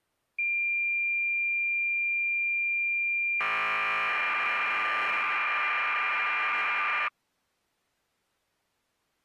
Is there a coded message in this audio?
Yes: cassette data (Kansas City type), 1200 baud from 0.4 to 7.1 s, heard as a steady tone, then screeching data.